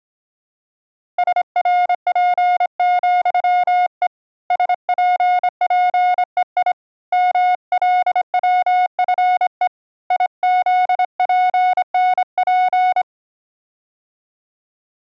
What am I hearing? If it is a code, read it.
Morse code, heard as a keyed tone, hand-sent with a straight key, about 26 wpm, 720 Hz. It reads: SRP,E SPPEI MLWFE IZPNP